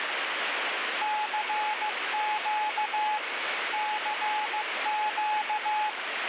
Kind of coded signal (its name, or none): Morse code